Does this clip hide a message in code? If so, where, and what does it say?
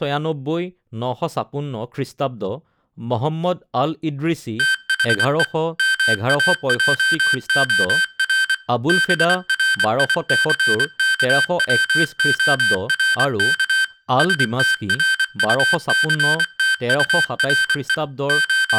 Yes: Morse code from 4.5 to 18.8 s, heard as electronic beeps, machine-sent, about 24 wpm, 1550 Hz, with room echo and speech in Assamese. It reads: THE MAJOR BRICKWORK STRUCTURE …